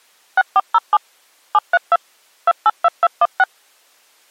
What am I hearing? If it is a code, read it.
DTMF, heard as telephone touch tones, dialled by machine, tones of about 40 ms. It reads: 6407 732 282216